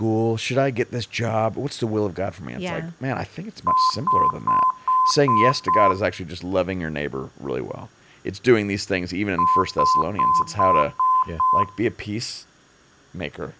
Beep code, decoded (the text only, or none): 6 short